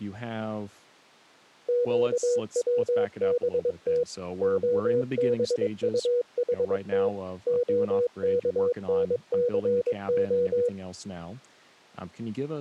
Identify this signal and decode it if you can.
Morse code (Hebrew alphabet), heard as a keyed tone, machine-sent, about 22 wpm, 490 Hz, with speech in English. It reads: קצבת הבטחת הכנסה